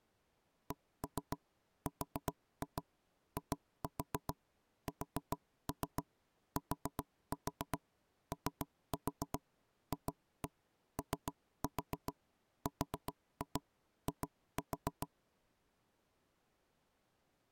Tap code, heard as knocks on wood, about 7 knocks a second. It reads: CRISTOFORI